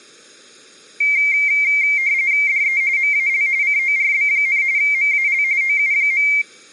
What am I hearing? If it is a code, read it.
RTTY (45.45 baud, 170 Hz shift), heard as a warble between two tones, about 2200 Hz centre. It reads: DE MAL CORB, MAL OU.